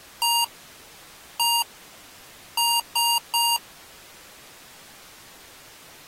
Beep code, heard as beeps from a small speaker, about 940 Hz. 1-1-3. In Phoenix BIOS tables: CMOS read or write failure.